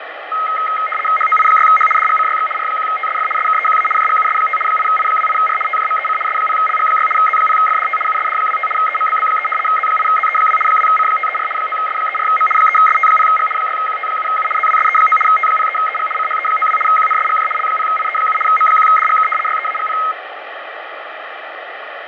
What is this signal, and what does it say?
RTTY (75 baud, 850 Hz shift), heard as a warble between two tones, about 1700 Hz centre, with radio static and fading. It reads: HOI6H DGCYX R1TSF SKEQA JGUS5 8I28R TJMEC S0LG6 Z0FDT USD25 EMBB3 Z8ZE2 2C534 9S34M 3ST0G 6QT7U ZWSE9 T03EG CHE92 QNSGJ L0IE7 M1DGK YEAGP